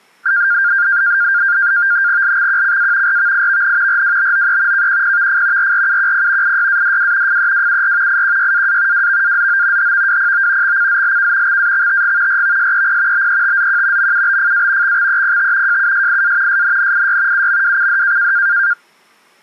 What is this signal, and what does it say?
NAVTEX (SITOR-B), 100 baud, 170 Hz shift, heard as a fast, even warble, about 1500 Hz centre. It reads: LXQCA RVIVN RWBOE KQPVF RRUQP IYADW FEWUR IQYAA WVAZO HVWPO XCZLK XAXTG RVSEP BETZQ MUBFA XXEPT JUSIA SNNIY UMWCD